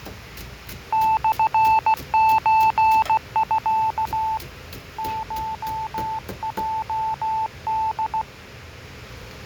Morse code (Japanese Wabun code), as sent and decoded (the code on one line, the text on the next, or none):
-..-. ---. ..-.- / ---- .--- -..
モソミ コヲホ